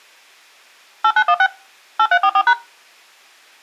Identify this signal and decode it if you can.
DTMF, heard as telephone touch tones, dialled by machine, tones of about 60 ms. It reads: 8916 8344#